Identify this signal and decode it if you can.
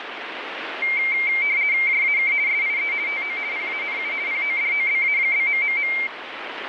RTTY (50 baud, 170 Hz shift), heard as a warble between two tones, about 2200 Hz centre, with radio static. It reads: JAK SIE TO PANU PODOBA?...